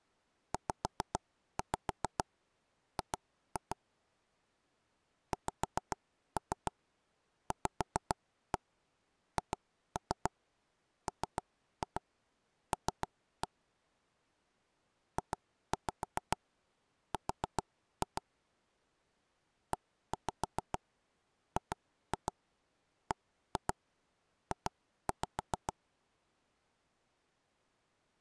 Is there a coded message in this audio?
Yes: tap code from 0.5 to 25.7 s, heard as knocks on wood, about 7 knocks a second. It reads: ZG XVHML JR EGBJ